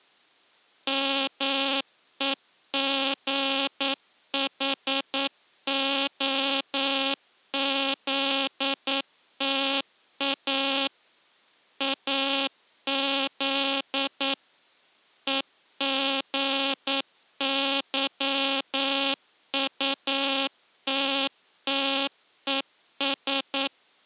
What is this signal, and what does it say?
Morse code, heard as a buzzer, machine-sent, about 9 wpm. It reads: MEGHOZTA AZ EGYUTTES